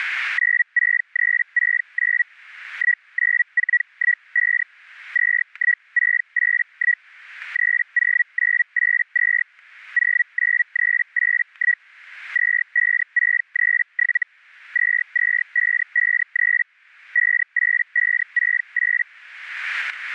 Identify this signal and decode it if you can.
Hellschreiber (Feld-Hell, 122.5 baud), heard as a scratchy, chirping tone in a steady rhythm, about 1950 Hz, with static crashes. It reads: 96369 19415 21681 30982 09381 25637 22553 58568